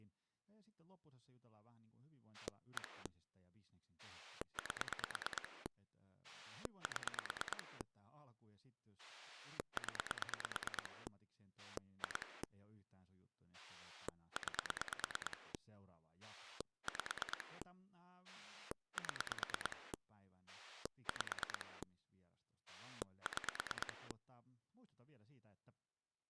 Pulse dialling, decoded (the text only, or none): 1 8 7 0 2 9 5 7 5 6